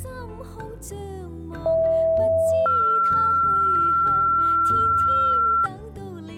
Two-tone page, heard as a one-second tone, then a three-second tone, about 650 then 1360 Hz.